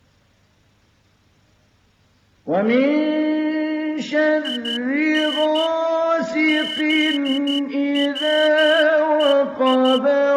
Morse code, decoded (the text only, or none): IN ZWEI